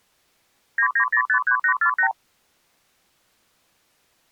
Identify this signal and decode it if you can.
Multi-frequency trunk signalling (R2, with the far end's replies), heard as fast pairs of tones, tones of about 90 ms. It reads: 99053848